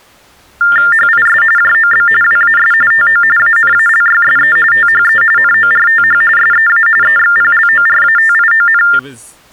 TTY/TDD text telephone tones (45.45 baud Baudot), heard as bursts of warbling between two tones, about 400 Hz shift, 1600 Hz centre, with speech in English. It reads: HIS JOB WAS TO ANALYSE THE NORTH SEA EXPLORATION